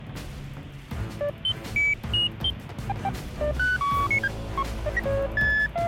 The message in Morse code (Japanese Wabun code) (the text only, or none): none